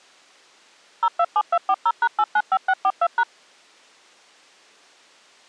DTMF, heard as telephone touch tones, dialled by machine, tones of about 60 ms. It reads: 027240#895642#